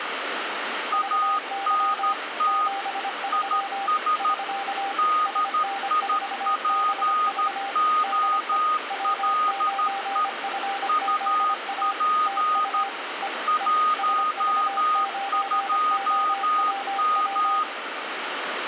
Morse code, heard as two keyed tones, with radio static and room echo. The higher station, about 13 wpm, 1240 Hz: ANT IS DIPOLE UP 12M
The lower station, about 25 wpm, 790 Hz: VY 73 <SK> SN4BV DE W9FZA TU E E SV9OWW